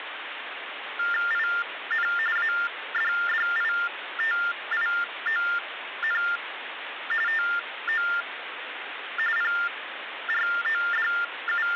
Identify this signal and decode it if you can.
TTY/TDD text telephone tones (45.45 baud Baudot), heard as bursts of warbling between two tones, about 400 Hz shift, 1600 Hz centre, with phone line noise. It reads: IN ADDITION TO …